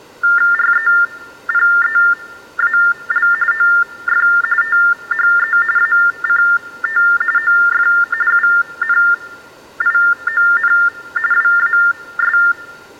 TTY/TDD text telephone tones (45.45 baud Baudot), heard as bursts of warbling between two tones, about 400 Hz shift, 1600 Hz centre. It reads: REPEAL OF THE ACT OF UNION WAS